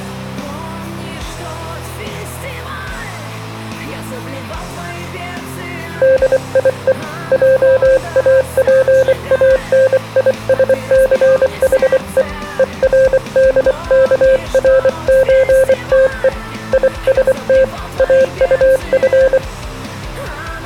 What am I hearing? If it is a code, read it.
Morse code (with German letters), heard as a keyed tone, hand-sent with a paddle, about 24 wpm, 530 Hz. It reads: DIE JAPANISCHE ERDKRÖTE IST AUF